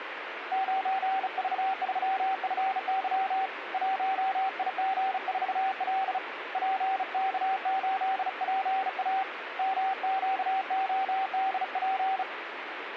Morse code, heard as a keyed tone, hand-sent with a bug key, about 35 wpm, 770 Hz, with radio static. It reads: 9V3FY 1IG4L PK8PA MQODP